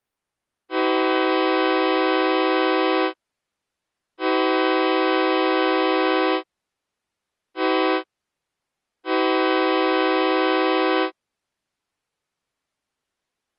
Train horn signal, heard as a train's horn. 2 long, 1 short, 1 long. On North American railways: approaching a public crossing.